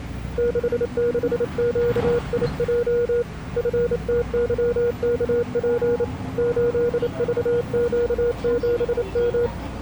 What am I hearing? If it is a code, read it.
Morse code, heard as a keyed tone, hand-sent with a bug key, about 28 wpm, 480 Hz, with the noise inside a bus. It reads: 66QIJ FTYKP 8VQ7M